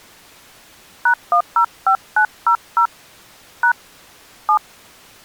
DTMF, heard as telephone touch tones, dialled by hand, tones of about 90 ms. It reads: #105900 # 7